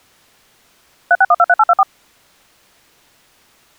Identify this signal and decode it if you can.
DTMF, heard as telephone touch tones, dialled by machine, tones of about 50 ms. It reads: 36123824